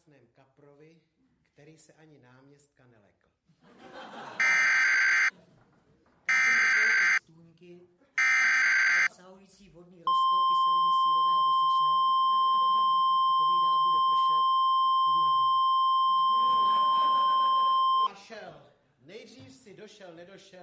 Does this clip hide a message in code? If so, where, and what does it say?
Yes: Emergency Alert System (SAME) tones (header bursts, then the 1050 Hz attention tone) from 4.4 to 18.1 s, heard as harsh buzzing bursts, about 520.83 baud.